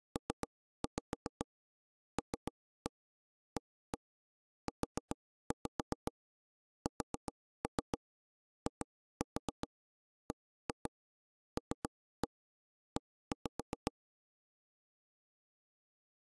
Tap code, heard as taps on a table, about 7 knocks a second. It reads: PLAUSIBLE